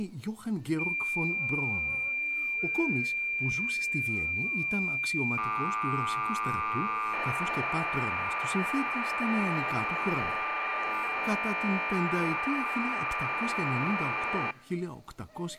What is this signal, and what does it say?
Cassette data (Kansas City type), 1200 baud, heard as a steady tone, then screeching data.